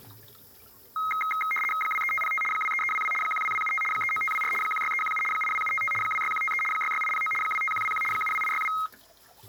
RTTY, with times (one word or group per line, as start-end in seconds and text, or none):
1.8-2.4 23505
2.5-3.1 23322
3.2-3.8 12275
3.9-4.5 39524
4.6-5.2 16317
5.3-5.9 82755
6.0-6.6 26153
6.7-7.3 66809
7.4-8.0 25121
8.1-8.7 72862